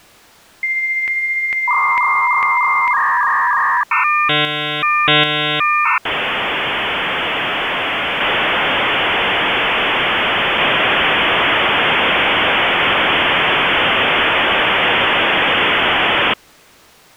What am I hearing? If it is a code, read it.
Dial-up modem handshake (V.34 or later), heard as a whistle, warbles, then hiss.